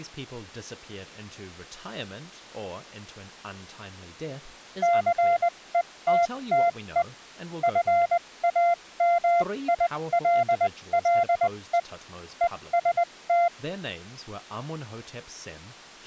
Morse code, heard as a keyed tone, machine-sent, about 20 wpm, spaced as for 17 wpm, 690 Hz, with speech in English. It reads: CETTE FAMILLE EST